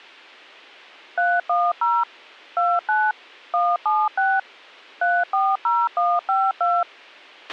DTMF, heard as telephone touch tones, dialled by machine, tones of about 220 ms, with a squelch burst at the end. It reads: 310 29 176 340152